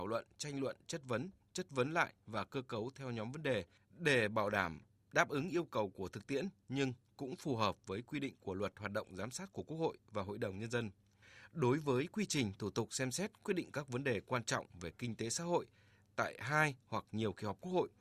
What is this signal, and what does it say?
Speech in Vietnamese. There is no code.